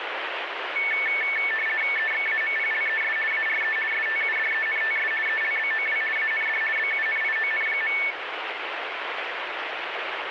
RTTY (50 baud, 450 Hz shift), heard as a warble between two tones, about 2000 Hz centre, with radio static. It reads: EXAMPLES ARE STUDENTS ELBOW AND BUNION.